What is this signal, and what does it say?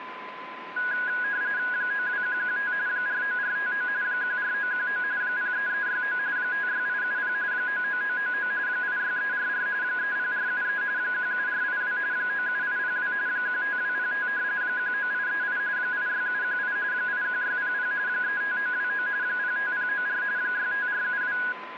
RTTY (45.45 baud, 170 Hz shift), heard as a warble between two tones, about 1550 Hz centre, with radio static and a steady whistle near 1020 Hz. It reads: 92115 49459 14919 03369 56870 99999 86344 30473 17482 97802 15205 19838 86718 81600 35929 05094 65472